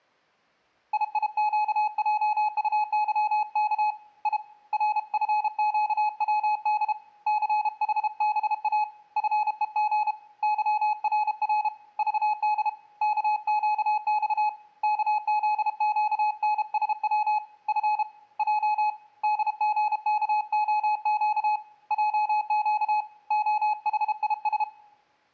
Morse code, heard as a keyed tone, hand-sent with a paddle, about 32 wpm, 850 Hz, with room echo. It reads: IIQJUYK I RFQWD CHBA FEG YRR VD KQX KZQNSW F J DGKOQ JQ OHIS